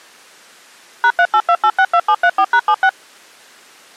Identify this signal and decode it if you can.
DTMF, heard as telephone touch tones, dialled by machine, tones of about 60 ms. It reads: #382862734#76